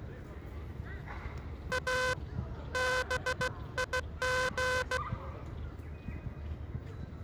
Morse code, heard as a buzzer, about 16 wpm, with the noise of a park. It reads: A BIG